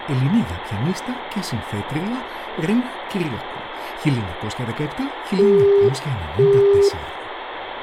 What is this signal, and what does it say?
Telephone call progress tone (single-tone plan, as in Europe, Japan and elsewhere), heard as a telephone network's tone, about 400 Hz, 0.5 s on and 0.5 s off, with phone line noise and room echo. Busy tone.